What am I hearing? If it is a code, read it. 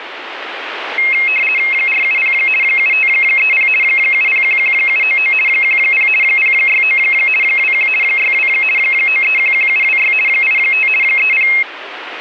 RTTY (50 baud, 450 Hz shift), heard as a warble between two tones, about 2350 Hz centre, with radio static. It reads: 470 7530 7011799 10 069 21 62 9311726 85 30